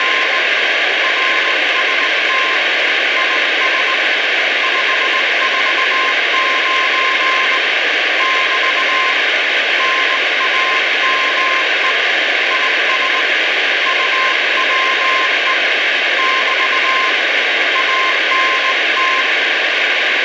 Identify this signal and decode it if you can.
Morse code, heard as a keyed tone, hand-sent with a straight key, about 19 wpm, 1050 Hz, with heavy radio static. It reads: … RST IS 549 <BT> NAME IS UWE <BT> ANT